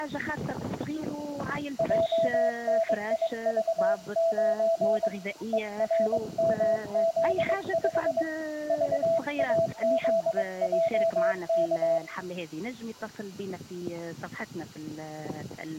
Morse code, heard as a keyed tone, hand-sent with a paddle, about 22 wpm, 660 Hz, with room echo. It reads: JNIV9 ERMZ5 VAZJK